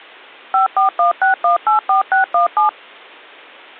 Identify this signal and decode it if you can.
DTMF, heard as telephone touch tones, dialled by machine, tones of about 120 ms. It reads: 5416184617